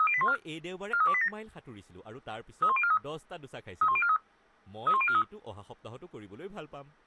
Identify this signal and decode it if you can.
Five-tone selective call (ZVEI), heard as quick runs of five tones, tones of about 70 ms, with speech in Assamese. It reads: 30814 43287 31043 31043 31043